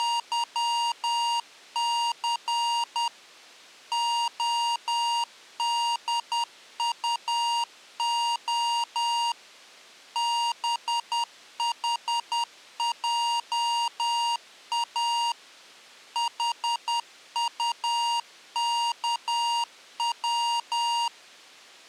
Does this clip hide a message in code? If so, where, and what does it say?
Yes: Morse code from 0.0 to 21.1 s, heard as electronic beeps, machine-sent, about 10 wpm, 940 Hz. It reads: … ODUO BHJA HUKW